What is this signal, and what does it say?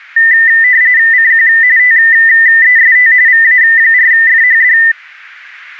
RTTY (45.45 baud, 170 Hz shift), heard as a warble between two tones, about 1900 Hz centre. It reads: CQ TEST VA4FHD